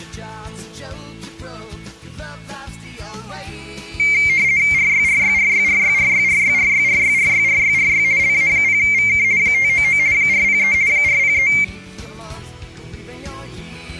RTTY (50 baud, 170 Hz shift), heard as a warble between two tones, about 2200 Hz centre. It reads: RYRYRYRYRYRYRYRYRYRYRY LA0VK 599 403 403